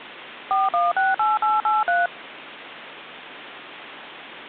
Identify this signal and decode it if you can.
DTMF, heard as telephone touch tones, dialled by machine, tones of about 180 ms, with phone line noise. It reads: 4168883